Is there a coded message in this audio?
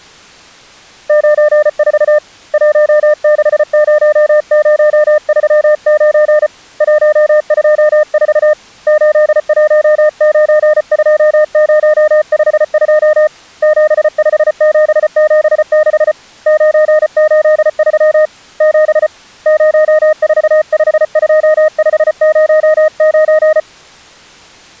Yes: Morse code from 1.0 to 23.7 s, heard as a keyed tone, hand-sent with a paddle, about 34 wpm, 610 Hz. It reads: 94 160039 124 8192052 75776 983 7 0452509